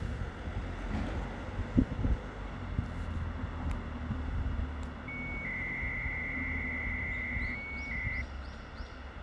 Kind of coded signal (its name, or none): 300-baud modem data